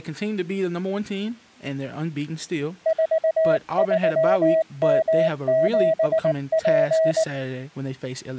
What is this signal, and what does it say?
Morse code, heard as a keyed tone, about 19 wpm, 640 Hz, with speech in English. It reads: 43M7P